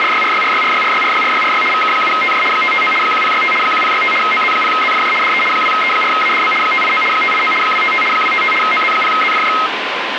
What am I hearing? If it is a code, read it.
RTTY (75 baud, 850 Hz shift), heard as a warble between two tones, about 1700 Hz centre, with radio static. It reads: … VK7TJ 559 1065 1065 OZ0ZFJ DE 2E4ADB 589 589 255 255 OZ0ZFJ